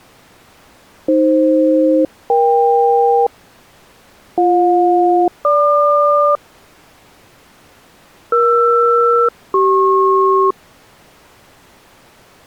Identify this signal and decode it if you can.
Aircraft SELCAL, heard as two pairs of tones. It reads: AF-EK BJ-GQ ER-CP